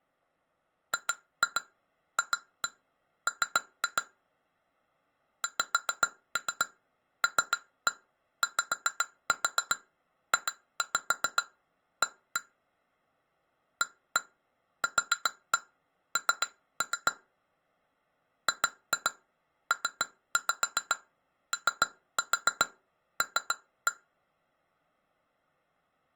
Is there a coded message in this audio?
Yes: tap code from 0.9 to 24.0 s, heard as taps on glass, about 7 knocks a second. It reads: GFM XLYJA AQN GPOL